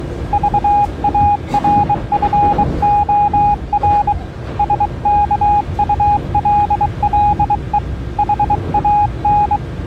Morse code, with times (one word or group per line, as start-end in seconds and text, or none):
0.3-4.1 VARFOR
4.6-7.8 SKULLE
8.2-9.6 HAN